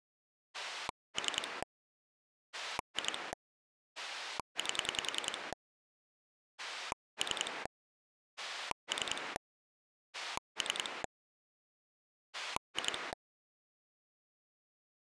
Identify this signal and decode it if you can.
Pulse dialling, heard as a rotary dial, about 10 pulses a second. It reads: 3 2 8 3 3 3 2